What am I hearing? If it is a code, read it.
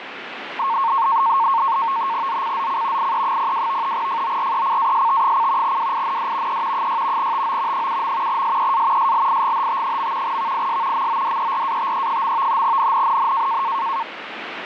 NAVTEX (SITOR-B), 100 baud, 170 Hz shift, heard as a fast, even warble, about 1000 Hz centre, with radio static. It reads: ZCZC IE02 FORECAST: WIND E 6 TO 7. SEA SLIGHT. VIS MODERATE. NNNN